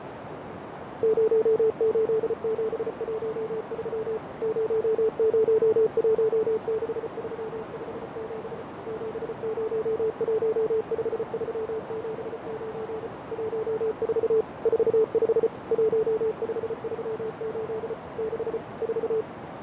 Morse code, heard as a keyed tone, machine-sent, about 34 wpm, 440 Hz, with heavy radio static, fading and a narrow filter. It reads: 08713 0016357 7015379 14 45 1538 6 4